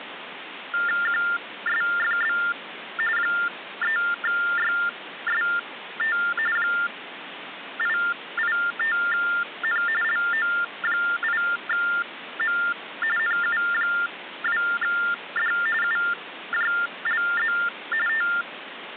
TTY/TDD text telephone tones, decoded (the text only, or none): QSFB 3YST 885N LO8M NU2D UJLZ …